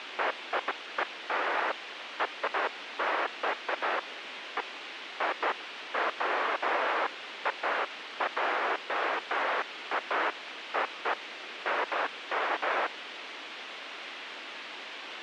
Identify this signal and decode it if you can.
Bursts of noise, with radio hiss. There is no code.